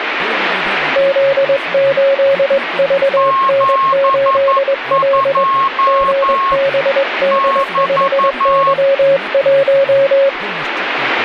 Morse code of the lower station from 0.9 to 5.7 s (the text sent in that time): Z8VN8L